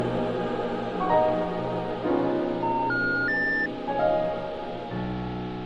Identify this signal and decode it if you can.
Telephone call progress tone (North American plan), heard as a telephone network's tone, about 910, 1430, 1800 Hz. Special information tone.